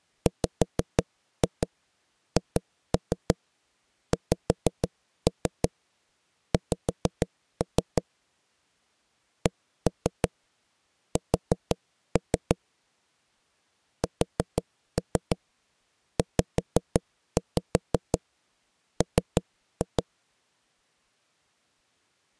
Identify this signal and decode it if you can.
Tap code, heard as knocks on wood, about 6 knocks a second. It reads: WHXX CS SZM